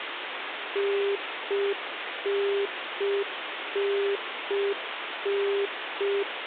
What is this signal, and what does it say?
Telephone call progress tone (UK plan), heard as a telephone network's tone, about 400 Hz, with phone line noise. Congestion tone.